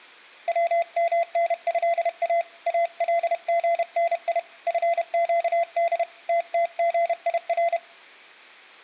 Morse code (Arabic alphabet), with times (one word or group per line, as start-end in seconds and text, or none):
0.5-2.4 ومنها
2.7-4.4 الغني
4.7-6.0 فقد
6.3-7.8 تتغير